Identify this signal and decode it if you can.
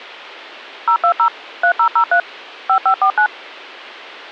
DTMF, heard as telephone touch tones, dialled by machine, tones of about 90 ms. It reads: 020 3003 5549